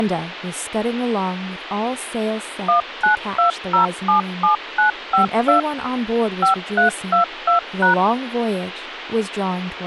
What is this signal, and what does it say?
DTMF, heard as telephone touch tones, dialled by machine, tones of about 120 ms, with phone line noise and speech in English. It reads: 192077952 5322#